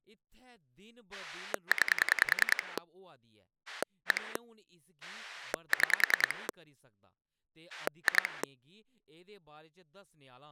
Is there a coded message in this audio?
Yes: pulse dialling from 1.1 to 8.4 s, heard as a rotary dial, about 10 pulses a second, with speech in Dogri. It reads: 9 1 6 2